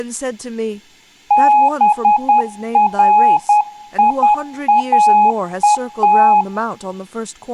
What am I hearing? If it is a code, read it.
Morse code (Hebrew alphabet), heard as a keyed tone, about 10 wpm, 840 Hz, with room echo and speech in English. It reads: בריאות